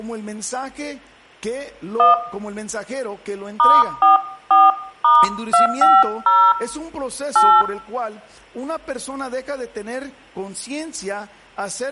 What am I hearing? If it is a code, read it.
DTMF, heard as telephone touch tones, dialled by hand, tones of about 180 ms, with room echo. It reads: 1 *44*250 8